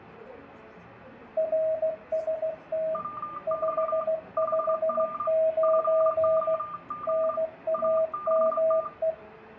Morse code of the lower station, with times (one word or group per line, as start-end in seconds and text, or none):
1.4-3.0 RST
3.5-6.6 559
7.1-9.1 NAME